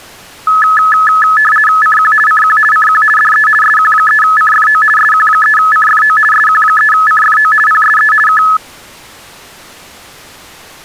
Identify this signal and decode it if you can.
RTTY (50 baud, 450 Hz shift), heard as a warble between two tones, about 1500 Hz centre. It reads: CQ CQ CQ DE SQ3CFO SQ3CFO SQ3CFO PSE K